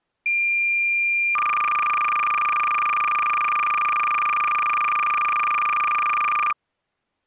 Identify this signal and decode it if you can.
Cassette data (Kansas City type), 300 baud, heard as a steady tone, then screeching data.